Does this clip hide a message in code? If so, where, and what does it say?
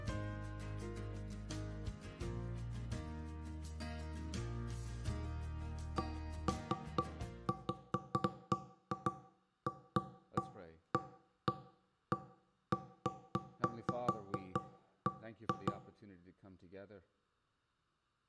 No, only irregular knocks on wood, with room echo.